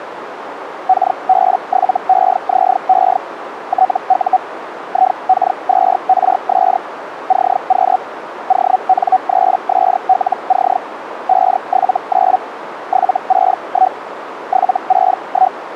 Hellschreiber (Feld-Hell, 122.5 baud), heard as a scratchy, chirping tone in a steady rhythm, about 750 Hz, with radio static and a narrow filter. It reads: KB7EZE TU IK2RS CQ ON3SLC 579 761 761